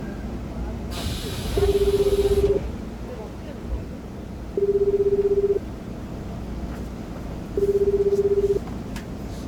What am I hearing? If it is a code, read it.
Telephone call progress tone (Japanese plan), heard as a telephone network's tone, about 380, 400, 420 Hz, 1 s on and 2 s off, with the noise inside a subway train. Ringback tone.